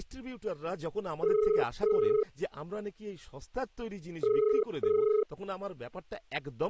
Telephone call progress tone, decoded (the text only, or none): ringback tone